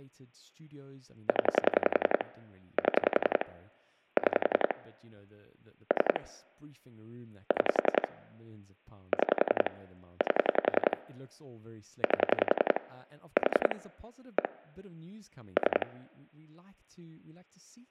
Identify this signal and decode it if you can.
Pulse dialling, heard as clicks on a phone line, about 11 pulses a second, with speech in English. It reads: 0 7 6 3 6 6 8 8 4 1 3